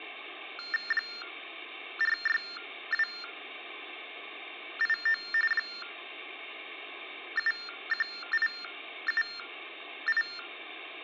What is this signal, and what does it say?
TTY/TDD text telephone tones (45.45 baud Baudot), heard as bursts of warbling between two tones, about 400 Hz shift, 1600 Hz centre. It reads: 46289 71878